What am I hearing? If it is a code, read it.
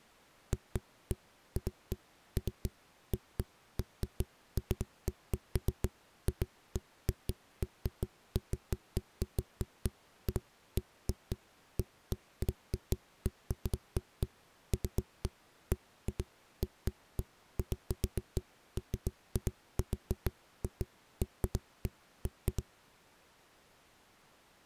Irregular knocks on a wall. There is no code.